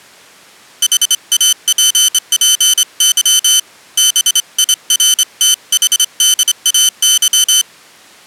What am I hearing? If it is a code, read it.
Morse code, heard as a high beeper, hand-sent with a straight key, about 26 wpm, 3050 Hz. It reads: HAPPY BIRTHDAY